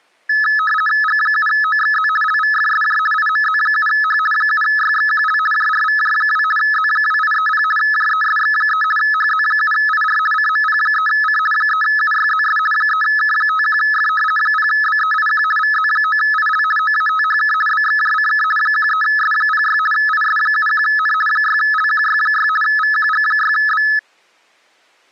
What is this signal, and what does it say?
RTTY (50 baud, 450 Hz shift), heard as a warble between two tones, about 1500 Hz centre. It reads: G7OXZ LVFSJ IMZ7H 7YXQL JRVJ2 Z2830 JESX3 HZ7IR CMP3C 3UYZS 3K51F 0BEIQ VZ9IL OATHK BXJCK 13S06 IS71N 6LQY6 VQG6B